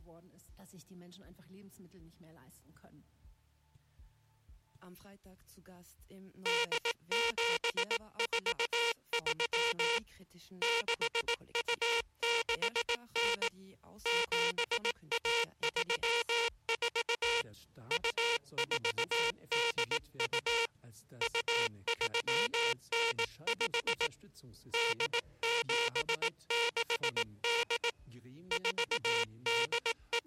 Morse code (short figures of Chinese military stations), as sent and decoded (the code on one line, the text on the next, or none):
-.. --... ....- ...-- / -.... ..- -.... -. / --... .- ...-- ....- / ..- ....- -.. ..- / ..- ...-- -. ..... / -.. --... -.... -.. / …
8743 6269 7134 2482 2395 8768 …